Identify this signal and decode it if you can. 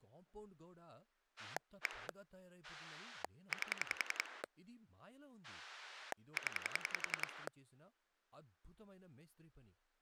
Pulse dialling, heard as a rotary dial, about 10 pulses a second, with speech in Telugu. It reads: 1 8 0